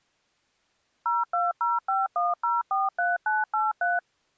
DTMF, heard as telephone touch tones, dialled by machine, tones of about 180 ms. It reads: 02051043983